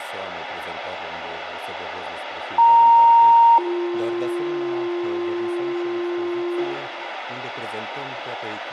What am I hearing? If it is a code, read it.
Two-tone page, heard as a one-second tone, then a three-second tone, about 930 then 350 Hz, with radio hiss and room echo.